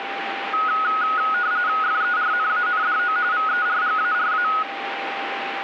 RTTY (45.45 baud, 170 Hz shift), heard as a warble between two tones, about 1360 Hz centre, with radio static and a steady whistle near 790 Hz. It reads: FERNANDO VERGARA